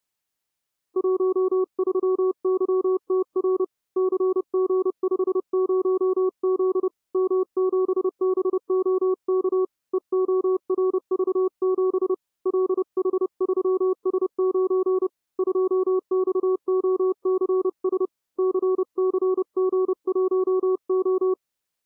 Morse code, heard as a keyed tone, hand-sent with a paddle, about 30 wpm, 370 Hz. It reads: 13YTR CG50Z M7BOK EORV7 LH3S9 2XOCS CCG1O